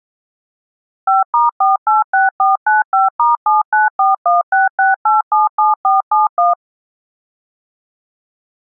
DTMF, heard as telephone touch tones, dialled by machine, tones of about 160 ms. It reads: 5*486495*794166877471